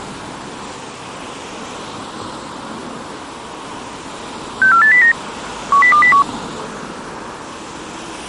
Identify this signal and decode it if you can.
Five-tone selective call (CCIR), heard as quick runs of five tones, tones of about 100 ms, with street noise. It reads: 64809 10201